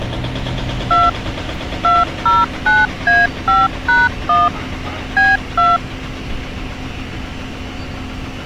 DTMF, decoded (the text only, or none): 2 209A5#1 B2